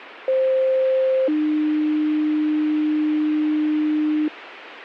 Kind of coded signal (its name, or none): two-tone page